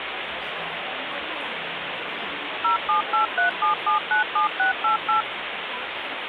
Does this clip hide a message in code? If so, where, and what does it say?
Yes: DTMF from 2.6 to 5.2 s, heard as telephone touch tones, dialled by machine, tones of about 120 ms, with phone line noise and the noise of a cafe. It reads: 07837797688